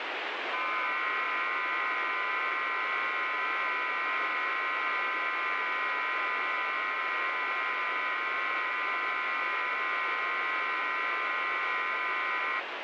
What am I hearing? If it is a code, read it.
FT8 (several signals at once), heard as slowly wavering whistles, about 6.25 baud, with heavy radio static.